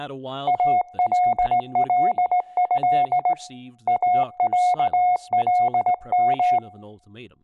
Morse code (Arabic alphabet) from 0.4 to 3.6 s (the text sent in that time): الله